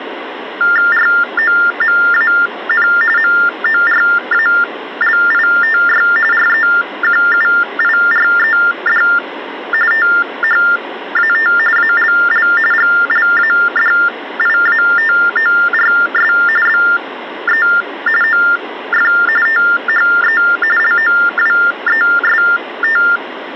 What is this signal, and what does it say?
TTY/TDD text telephone tones (45.45 baud Baudot), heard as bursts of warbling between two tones, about 400 Hz shift, 1600 Hz centre, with phone line noise. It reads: ROMAN MORALITY REQUIRED THAT ALL GLADIATORS BE OF THE LOWEST